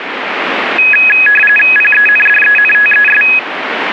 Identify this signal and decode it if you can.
RTTY (45.45 baud, 850 Hz shift), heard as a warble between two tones, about 2100 Hz centre, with radio static. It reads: PENDENTES